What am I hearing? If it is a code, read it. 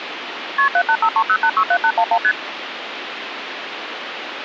Multi-frequency trunk signalling (R1, as on North American trunks), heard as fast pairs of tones, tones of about 70 ms, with phone line noise. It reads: KP 78530867811 ST